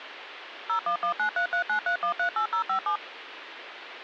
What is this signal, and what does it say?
DTMF, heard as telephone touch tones, dialled by machine, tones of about 100 ms, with phone line noise. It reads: 01193393138057